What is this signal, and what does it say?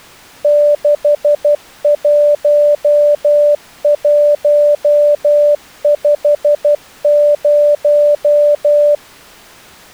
Morse code, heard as a keyed tone, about 12 wpm, 590 Hz. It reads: 61150